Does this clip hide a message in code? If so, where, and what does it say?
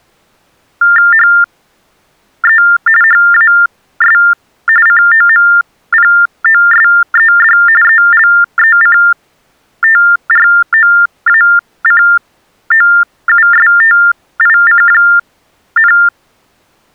Yes: TTY/TDD text telephone tones (45.45 baud Baudot) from 0.8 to 16.1 s, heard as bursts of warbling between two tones, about 400 Hz shift, 1600 Hz centre. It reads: HE HAS COMPOSED ELECTROACOUSTIC,